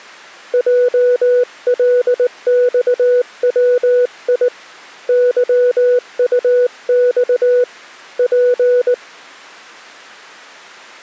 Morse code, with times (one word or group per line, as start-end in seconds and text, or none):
0.5-4.5 JLXWI
5.1-7.6 YUX
8.2-8.9 P